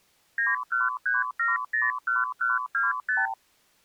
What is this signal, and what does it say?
Multi-frequency trunk signalling (R2, with the far end's replies), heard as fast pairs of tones, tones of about 170 ms. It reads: 913701125